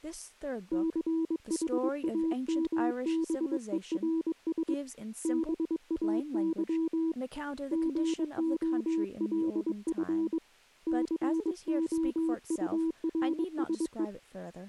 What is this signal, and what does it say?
Morse code, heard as a keyed tone, hand-sent with a paddle, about 22 wpm, 320 Hz, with speech in English. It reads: CHAMBERS BAY GOLF COURSE